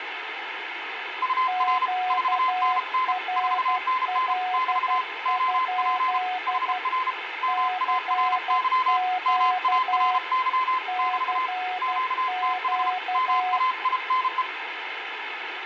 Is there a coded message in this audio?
Yes: Morse code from 1.2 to 14.5 s, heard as two keyed tones, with radio static and room echo. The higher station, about 33 wpm, 1030 Hz: UR 4NN 4NN <BT> OP HR MARY MARY <BT> QTH MAINE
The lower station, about 12 wpm, 740 Hz: QRL? CQ CQ